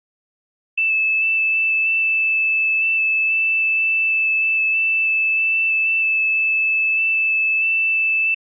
FT8 (one signal), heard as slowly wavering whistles, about 6.25 baud.